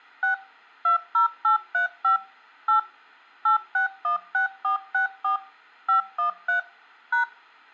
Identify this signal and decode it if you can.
DTMF, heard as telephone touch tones, dialled by machine, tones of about 120 ms. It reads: 6 20835 8 8616464 513 #